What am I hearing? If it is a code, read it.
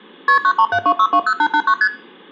Multi-frequency trunk signalling (R1, as on North American trunks), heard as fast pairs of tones, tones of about 70 ms, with room echo. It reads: KP 9372620889 ST